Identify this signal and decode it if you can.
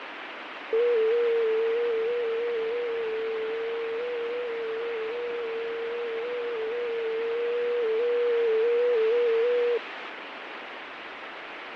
FT8 (one signal), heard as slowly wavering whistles, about 6.25 baud, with radio static and fading.